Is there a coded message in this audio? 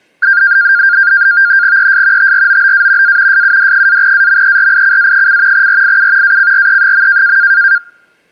Yes: NAVTEX (SITOR-B), 100 baud, 170 Hz shift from 0.2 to 7.8 s, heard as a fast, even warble, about 1500 Hz centre. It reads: ES TROBA A SUD-AMERICA: RIU ACRE.